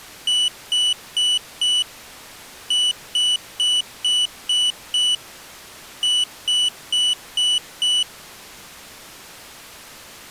Beep code, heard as a piezo beeper, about 2950 Hz. 4-6-5.